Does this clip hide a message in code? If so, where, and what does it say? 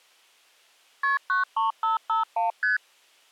Yes: multi-frequency trunk signalling (R1, as on North American trunks) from 1.0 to 2.8 s, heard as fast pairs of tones, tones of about 140 ms. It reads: KP 93551 ST